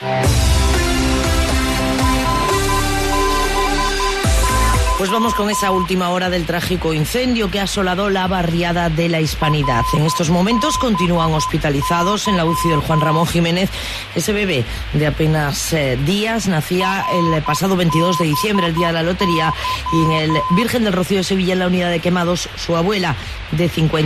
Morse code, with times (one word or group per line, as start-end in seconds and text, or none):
2.0-5.9 RBY
9.4-13.2 RBY
16.8-20.6 RBY